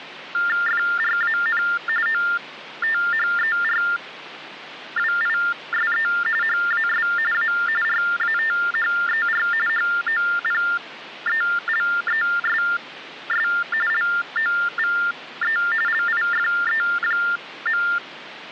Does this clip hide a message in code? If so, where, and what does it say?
Yes: TTY/TDD text telephone tones (45.45 baud Baudot) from 0.3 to 18.0 s, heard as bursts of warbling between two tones, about 400 Hz shift, 1600 Hz centre, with phone line noise. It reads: FRAN OTHERWISE HAS A RATHER HOPELESS LOVE LIFE.